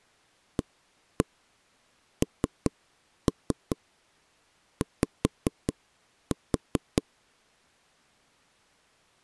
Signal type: tap code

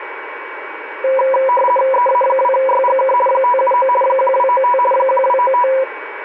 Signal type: RTTY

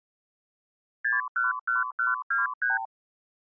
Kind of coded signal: multi-frequency trunk signalling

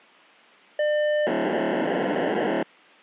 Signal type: POCSAG pager data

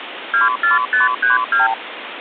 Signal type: multi-frequency trunk signalling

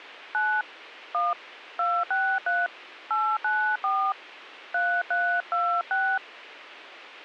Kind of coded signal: DTMF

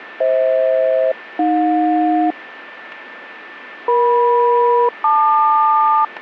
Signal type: aircraft SELCAL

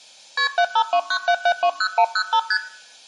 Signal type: multi-frequency trunk signalling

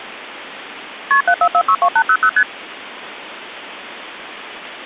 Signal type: multi-frequency trunk signalling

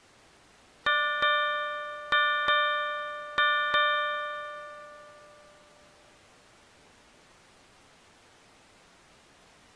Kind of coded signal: ship's bell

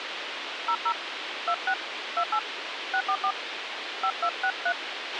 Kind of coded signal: DTMF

